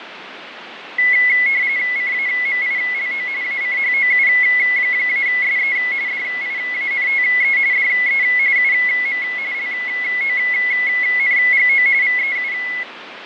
RTTY (45.45 baud, 170 Hz shift), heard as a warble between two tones, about 2100 Hz centre, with radio static and fading. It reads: CAMILO ACHOU-SE DIANTE DE UM LONGO VEU